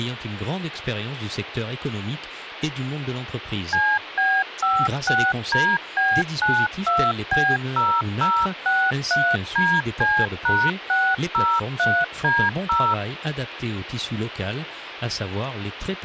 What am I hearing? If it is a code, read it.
DTMF, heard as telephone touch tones, dialled by machine, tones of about 250 ms, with phone line noise. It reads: CB56DB92B0063DC#603D0